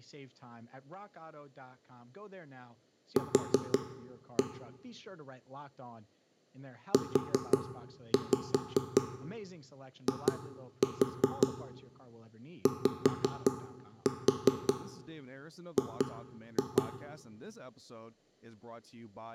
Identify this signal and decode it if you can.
Tap code, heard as knocks on wood, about 5 knocks a second, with room echo and speech in English. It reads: Q UIYG